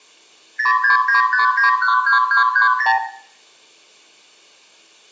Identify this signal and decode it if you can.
Multi-frequency trunk signalling (R2, with the far end's replies), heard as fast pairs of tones, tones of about 120 ms, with room echo. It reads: 0695912230